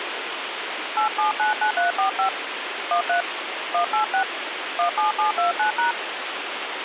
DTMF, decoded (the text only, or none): 8799345 13 186 17729#